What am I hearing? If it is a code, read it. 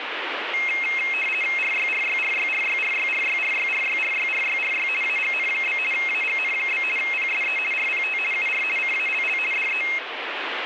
RTTY (50 baud, 450 Hz shift), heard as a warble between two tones, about 2350 Hz centre, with radio static. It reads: RYRYRYRYRYRYRYRYRYRYRY AGN? AGN? PSE RPT UR CALL DE